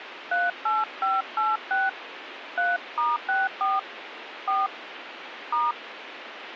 DTMF, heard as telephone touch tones, dialled by hand, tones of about 190 ms, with radio hiss. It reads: 38586 3*64 4 *